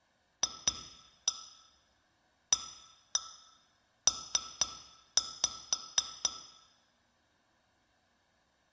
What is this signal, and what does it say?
Tap code, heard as taps on glass, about 4 knocks a second, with room echo. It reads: FAP